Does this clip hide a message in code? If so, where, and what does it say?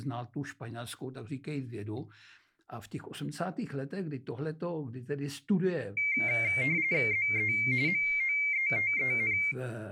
Yes: RTTY (45.45 baud, 170 Hz shift) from 6.0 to 9.5 s, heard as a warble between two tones, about 2200 Hz centre, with speech in Czech. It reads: ZE MOETEN